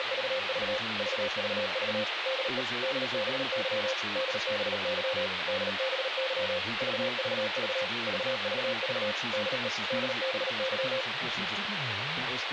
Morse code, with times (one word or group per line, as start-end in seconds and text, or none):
0.0-0.8 …
1.0-2.0 VVV
2.3-2.6 DE
2.8-3.9 DBY
4.2-5.3 DBY
5.5-6.6 DBY
6.8-7.8 VVV
8.1-9.1 VVV
9.3-9.7 DE
9.9-11.0 DBY